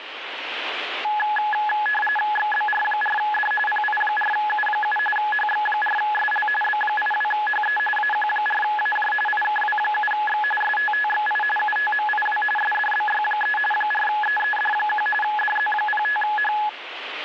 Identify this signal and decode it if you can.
RTTY (45.45 baud, 850 Hz shift), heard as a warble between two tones, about 1270 Hz centre, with radio static. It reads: XBR4D PI4U7 HX4SL B82HE AQ4AJ IKW7X STTXI UTMIW SDBY3 4EED1 DZ05H